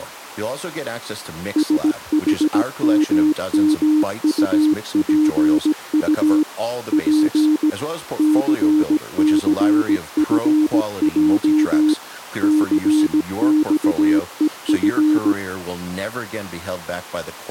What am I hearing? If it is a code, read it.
Morse code, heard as a keyed tone, machine-sent, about 17 wpm, 310 Hz, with speech in English. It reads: SHMMUPU P CCFJ CXEF